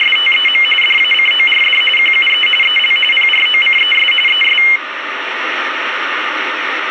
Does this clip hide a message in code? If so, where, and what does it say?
Yes: RTTY (45.45 baud, 850 Hz shift) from 0.0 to 4.8 s, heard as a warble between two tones, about 2550 Hz centre, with radio static. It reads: … DACORD QUE EL PROCES ES